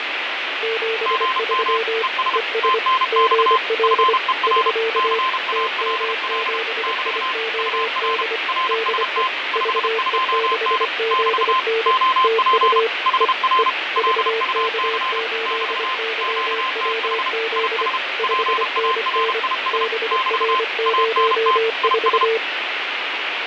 Morse code, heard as two keyed tones, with heavy radio static and fading. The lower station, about 25 wpm, 450 Hz: 73 ES GL <SK> TM7IOD DE VE6ZN TU E E VK8YWZ 5NN BR04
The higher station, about 32 wpm, 1040 Hz: GM ES TNX FER CALL <BT> UR RST 52N <BT> OP HR LUC <BT> QTH IS PARIS <BT> ANT IS